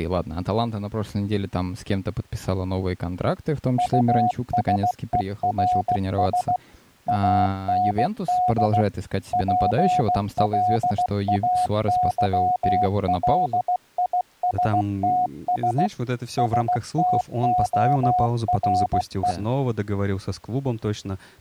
Morse code, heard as a keyed tone, machine-sent, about 16 wpm, 730 Hz, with speech in Russian. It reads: USERS AND PLAYLISTS STORE